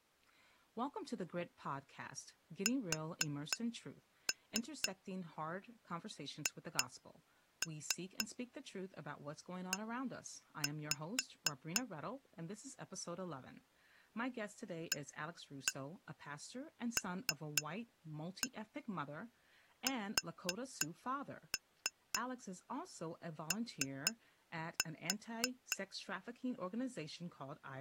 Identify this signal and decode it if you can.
Tap code, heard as taps on glass, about 3 knocks a second, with speech in English. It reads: SHE ALSO